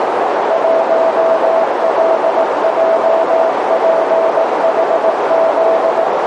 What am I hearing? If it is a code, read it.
Morse code, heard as a keyed tone, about 18 wpm, 660 Hz, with heavy radio static and a narrow filter. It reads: 1LJPHZ